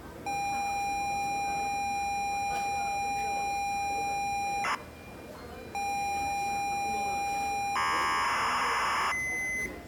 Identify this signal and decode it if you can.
ZX Spectrum tape loading, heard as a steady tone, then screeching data, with the noise of a restaurant.